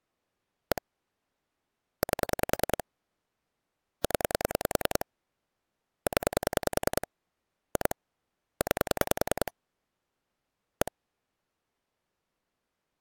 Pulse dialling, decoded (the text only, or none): 1 8 0 0 2 9 1